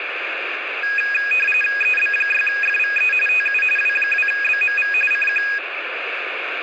RTTY (45.45 baud, 850 Hz shift), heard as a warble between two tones, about 2050 Hz centre, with radio static. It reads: EB6FVE TU W2BMV CQ